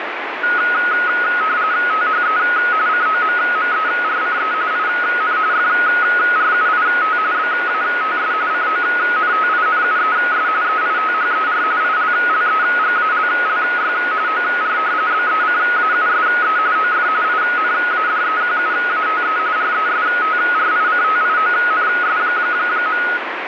RTTY (45.45 baud, 170 Hz shift), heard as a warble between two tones, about 1360 Hz centre, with radio static. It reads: THE COMMERCE IN FRUIT BATS CONTINUES EITHER ILLEGALLY OR BECAUSE OF INADEQUATE RESTRICTIONS.